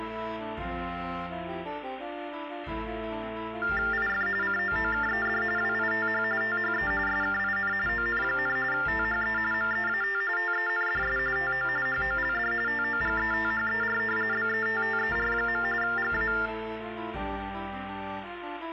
TTY/TDD text telephone tones (45.45 baud Baudot), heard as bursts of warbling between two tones, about 400 Hz shift, 1600 Hz centre, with phone line noise. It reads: IF COOKED WITH THE SKIN ON, THE MEAT TENDS TO HOLD TOGETHER BETTER. GA